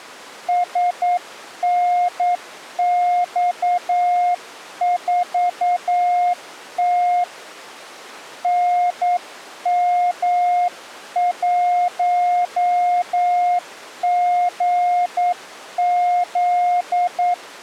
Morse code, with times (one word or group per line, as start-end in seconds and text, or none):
0.5-7.2 SNX4T
8.4-17.3 NM1GZ